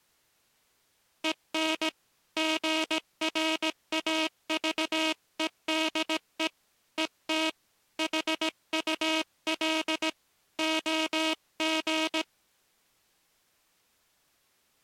Morse code, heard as a buzzer, hand-sent with a paddle, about 17 wpm. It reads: EN GRAVEDE ET HUL OG